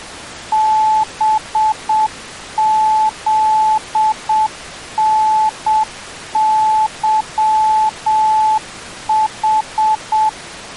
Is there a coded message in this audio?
Yes: Morse code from 0.5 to 10.4 s, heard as a keyed tone, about 7 wpm, 870 Hz. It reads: BZNYH